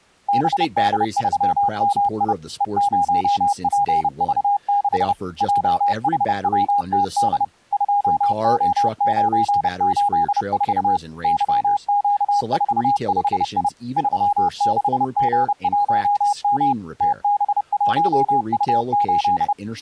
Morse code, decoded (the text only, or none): BD3MI E0PV6 JHWTD 2O984 YQ45I 36G1M TB1U8